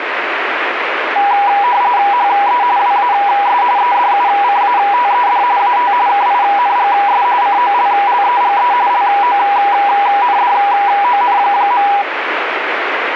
RTTY (45.45 baud, 170 Hz shift), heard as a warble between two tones, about 890 Hz centre, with radio static. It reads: HE WAS EDUCATED AT KINGS COLLEGE LONDON.